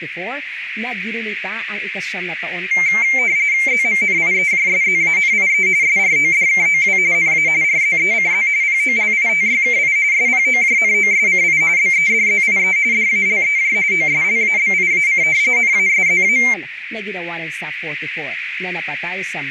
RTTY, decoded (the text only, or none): ZMNIEJSZANIE SRODKOW NA RZECZ POLITYKI SPOJNOSCI BEDZIE DALEJ OSLABIAC NASZA